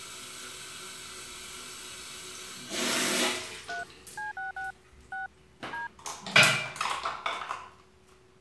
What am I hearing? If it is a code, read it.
DTMF, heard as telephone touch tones, dialled by machine, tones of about 140 ms, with the noise of a restroom. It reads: 3 C66 6 D